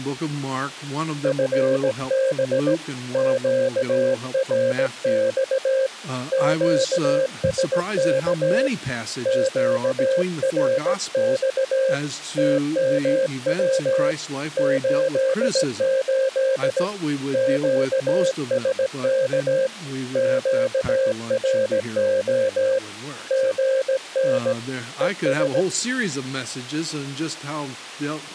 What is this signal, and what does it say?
Morse code, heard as a keyed tone, hand-sent with a straight key, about 17 wpm, 530 Hz. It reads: FB QRX QSK QRX TMW 88 QSK QRO GN ES